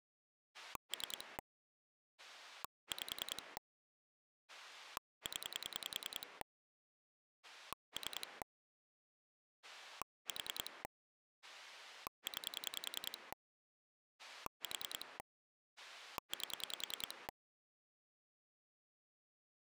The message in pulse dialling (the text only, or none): 3 5 0 3 4 9 4 8